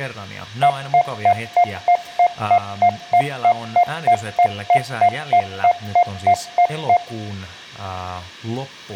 Evenly repeated beeps, with room echo and speech in Finnish. There is no code.